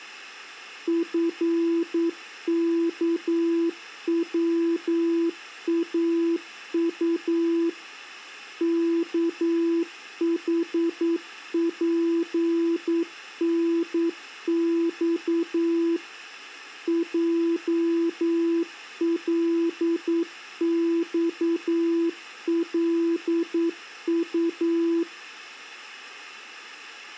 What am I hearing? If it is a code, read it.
Morse code, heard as a keyed tone, machine-sent, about 9 wpm, 340 Hz. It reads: FKWAU KHPNX JLXLU